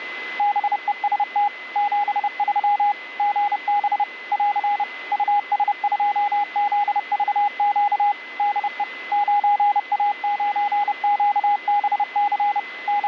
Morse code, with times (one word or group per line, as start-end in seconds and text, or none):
0.4-1.5 BEST
1.8-2.9 73
3.2-4.0 GB
4.3-4.8 <AR>
5.1-8.1 US2ZVQ
8.4-8.8 DE
9.1-12.6 9A9QBC
12.9-13.1 …